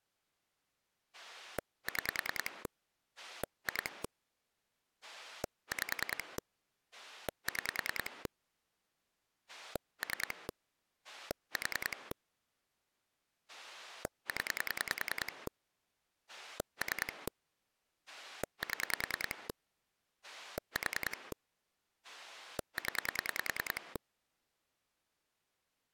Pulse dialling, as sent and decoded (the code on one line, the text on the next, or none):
6 / 2 / 5 / 6 / 3 / 4 / 10 / 3 / 7 / 4 / 10
6 2 5 6 3 4 0 3 7 4 0